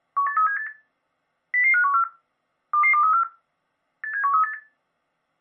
Five-tone selective call (CCIR), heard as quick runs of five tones, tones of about 100 ms. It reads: 18378 00514 22234 87138